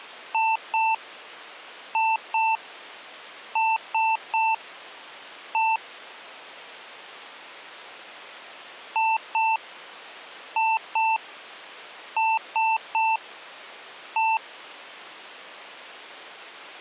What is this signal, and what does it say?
Beep code, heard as beeps from a small speaker, played twice, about 890 Hz. 2-2-3-1. In Phoenix BIOS tables: unexpected interrupt.